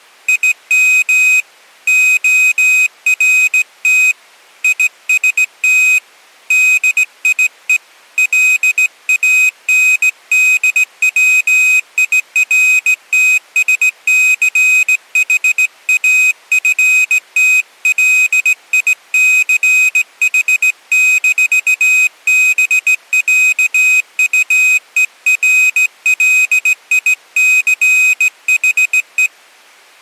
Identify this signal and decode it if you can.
Morse code (with German letters), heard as a high beeper, hand-sent with a straight key, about 17 wpm, 2500 Hz. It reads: IM ORT IST DIE LANDWIRTSCHAFTLICH-BÄUERLICHE